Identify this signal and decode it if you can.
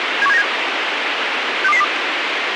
Five-tone selective call (EEA), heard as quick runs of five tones, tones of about 40 ms, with radio hiss. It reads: 71797 62202